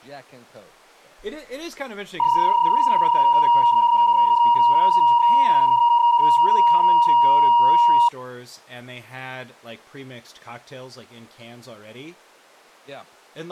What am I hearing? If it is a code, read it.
PSK31 (31.25 baud), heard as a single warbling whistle, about 950 Hz, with speech in English.